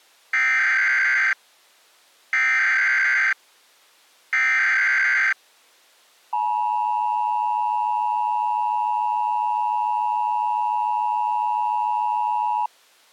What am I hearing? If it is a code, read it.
Emergency Alert System (SAME) tones (header bursts, then the 853 and 960 Hz attention tone), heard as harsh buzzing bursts, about 520.83 baud.